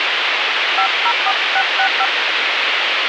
DTMF, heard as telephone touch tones, dialled by hand, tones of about 70 ms, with radio hiss. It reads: 504665